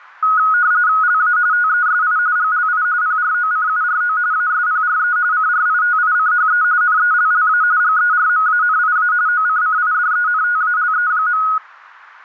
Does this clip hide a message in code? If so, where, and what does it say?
Yes: RTTY (45.45 baud, 170 Hz shift) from 0.2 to 11.6 s, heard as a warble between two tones, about 1360 Hz centre. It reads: LA TESI GLI PROCURO ASPRE CRITICHE NELLA GERMANIA OCCIDENTALE.